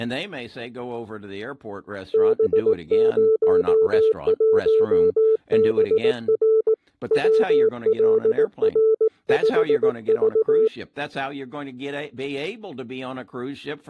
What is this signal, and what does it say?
Morse code, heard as a keyed tone, hand-sent with a paddle, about 18 wpm, 440 Hz, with speech in English. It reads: B01BR WLR5V